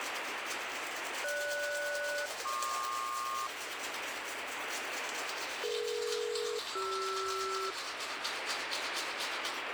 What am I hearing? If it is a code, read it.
Aircraft SELCAL, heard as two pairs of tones, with radio static and the noise of a restroom. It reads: GS-PQ DE-CR